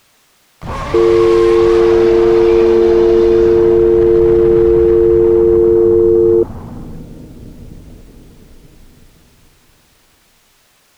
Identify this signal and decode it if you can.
Telephone call progress tone (North American or UK plan), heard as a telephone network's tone, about 350, 450 Hz. Dial tone.